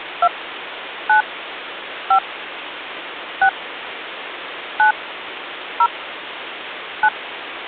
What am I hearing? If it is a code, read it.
DTMF, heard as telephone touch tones, dialled by hand, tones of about 80 ms, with phone line noise. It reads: 2 9 5 6 9 0 9